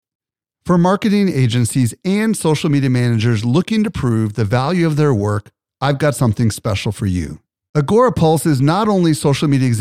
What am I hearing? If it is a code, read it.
Speech in English. There is no code.